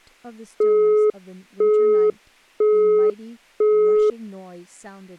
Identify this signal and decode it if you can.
Telephone call progress tone (single-tone plan, as in Europe, Japan and elsewhere), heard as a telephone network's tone, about 420 Hz, 0.5 s on and 0.5 s off, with speech in English. Busy tone.